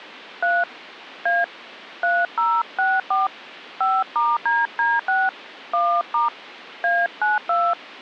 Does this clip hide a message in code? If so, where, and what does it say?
Yes: DTMF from 0.4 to 7.7 s, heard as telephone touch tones, dialled by hand, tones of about 210 ms. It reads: 3 A 3064 5*DD6 1* A92